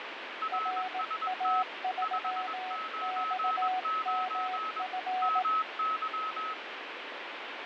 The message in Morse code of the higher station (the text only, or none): RST 599 MY